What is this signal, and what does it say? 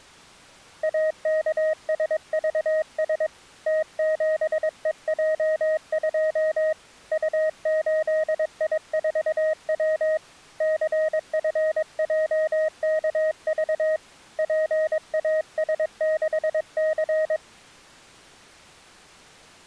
Morse code, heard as a keyed tone, hand-sent with a paddle, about 22 wpm, 630 Hz. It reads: AKSVS T7EJ2 U8I4W CFJKV PAS6C